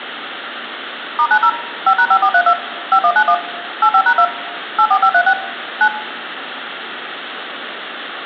DTMF, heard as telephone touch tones, dialled by machine, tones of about 70 ms, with phone line noise and room echo. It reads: *90 5#5432 5191 85#2 84536 9